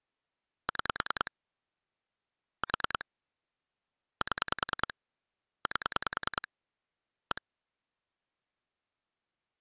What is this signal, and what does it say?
Pulse dialling, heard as clicks on a phone line, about 10 pulses a second. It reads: 6 4 7 8 1